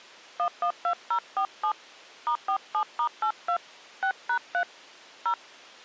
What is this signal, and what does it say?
DTMF, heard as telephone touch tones, dialled by hand, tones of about 80 ms. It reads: 112047 *47*82 6#3 0